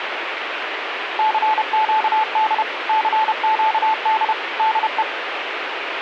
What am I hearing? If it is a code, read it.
Morse code, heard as a keyed tone, machine-sent, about 31 wpm, 870 Hz, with radio static. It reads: CQD CQD DE